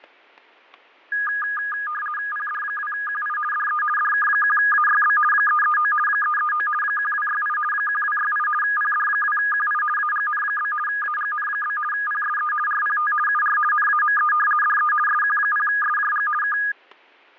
RTTY (50 baud, 450 Hz shift), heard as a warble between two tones, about 1440 Hz centre, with fading and static crashes. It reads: PD2QI DE DK1AYB 339 339 1268 1268 PD2QI AGN? AGN? PSE RPT UR NAME DE SQ0SJG K